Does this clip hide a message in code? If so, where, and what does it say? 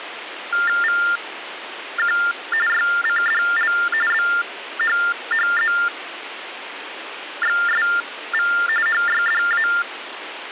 Yes: TTY/TDD text telephone tones (45.45 baud Baudot) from 0.5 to 9.8 s, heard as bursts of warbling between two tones, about 400 Hz shift, 1600 Hz centre, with phone line noise. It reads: VQ YCDL BHHZXSV HYDA